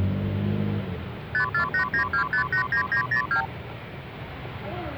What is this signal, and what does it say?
Multi-frequency trunk signalling (R2, with the far end's replies), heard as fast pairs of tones, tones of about 100 ms, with the noise of a residential street. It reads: 54892589902